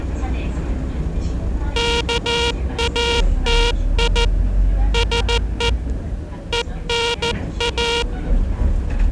Morse code (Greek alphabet), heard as a buzzer, hand-sent with a paddle, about 14 wpm, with the noise inside a bus. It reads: ΚΑΤΙ ΣΕ ΕΝΑ